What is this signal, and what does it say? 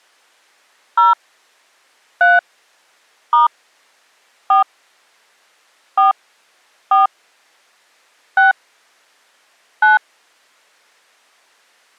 DTMF, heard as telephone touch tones, dialled by hand, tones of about 140 ms. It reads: 0 3 * 4 4 4 6 9